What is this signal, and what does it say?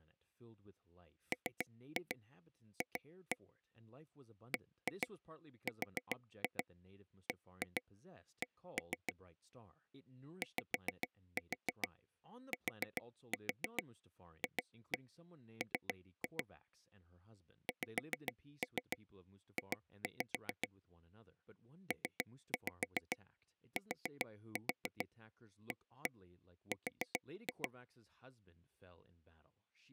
Tap code, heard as taps on a table, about 7 knocks a second, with speech in English. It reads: MF BRBC YTFM XJ PTAR